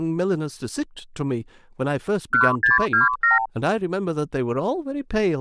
Multi-frequency trunk signalling (R2, with the far end's replies), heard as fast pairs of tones, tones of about 150 ms, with speech in English. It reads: 1627